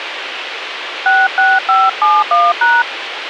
DTMF, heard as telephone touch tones, dialled by hand, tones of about 210 ms, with radio hiss and a squelch burst at the end. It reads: 66571#